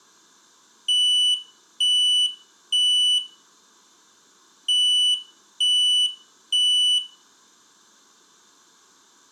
Alarm pattern, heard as an alarm's beeps, played twice, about 2950 Hz, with room echo. Temporal three. Smoke or fire, evacuate.